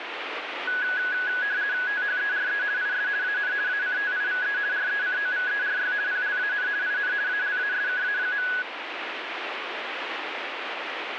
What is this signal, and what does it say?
RTTY (50 baud, 170 Hz shift), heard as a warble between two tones, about 1600 Hz centre, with radio static. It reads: THERE IS AN ACTIVE RECOVERY PLAN IN ALASKA.